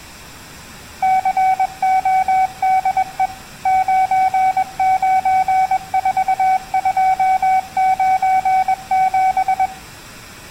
Morse code, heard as a keyed tone, machine-sent, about 21 wpm, 760 Hz. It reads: CODE 994297